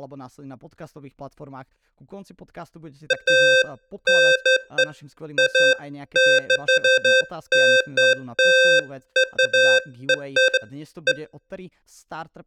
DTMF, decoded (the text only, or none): none